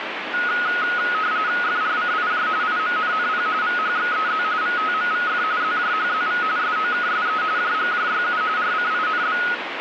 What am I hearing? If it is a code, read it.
RTTY (45.45 baud, 170 Hz shift), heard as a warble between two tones, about 1360 Hz centre, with radio static. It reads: FRCIJ IMNNP VHXEZ VTMVF ZJHZV SOKSE JGJYU RCINB